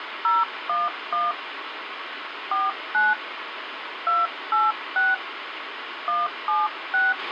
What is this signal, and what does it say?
DTMF, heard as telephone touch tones, dialled by hand, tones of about 190 ms, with radio hiss and a squelch burst at the end. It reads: 011 49 286 176